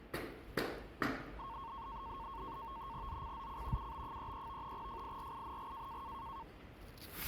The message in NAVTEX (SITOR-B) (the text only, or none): ZCZC UB33 FIRING